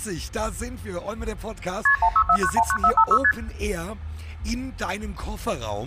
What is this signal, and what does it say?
Multi-frequency trunk signalling (R1, as on North American trunks), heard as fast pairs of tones, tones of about 70 ms. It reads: KP 164919456 ST